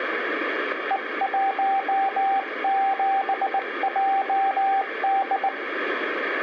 Morse code, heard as a keyed tone, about 19 wpm, 780 Hz, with room echo. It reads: E17JD